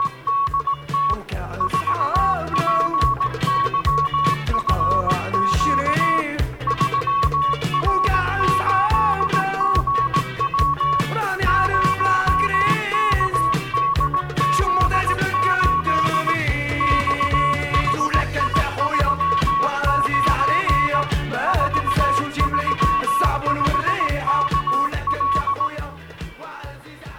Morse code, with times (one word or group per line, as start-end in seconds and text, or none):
0.0-1.1 …
1.6-6.2 4PYFQ
6.7-11.0 3R8GW
11.5-16.3 0KDZ8
16.8-21.0 XHI39
21.5-25.7 435KL